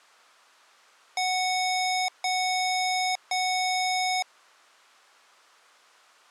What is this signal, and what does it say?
Beep code, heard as beeps from a small speaker, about 740 Hz. 3 long. In IBM BIOS tables: keyboard card error.